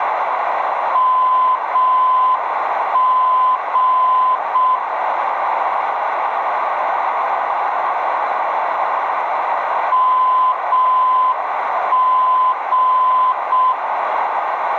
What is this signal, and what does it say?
Morse code, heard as a keyed tone, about 6 wpm, 1020 Hz, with radio static, a narrow filter and room echo. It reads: MG MG